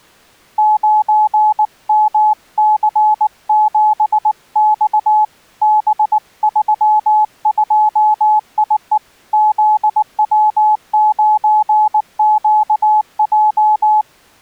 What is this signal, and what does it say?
Morse code, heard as a keyed tone, hand-sent with a paddle, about 19 wpm, 850 Hz. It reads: 9MC7X B32IE ZW9QJ